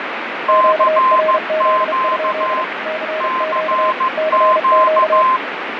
Morse code, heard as two keyed tones, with heavy radio static and fading. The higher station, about 15 wpm, 1040 Hz: CQ CQ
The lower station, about 32 wpm, 630 Hz: QRZ? CQ CQ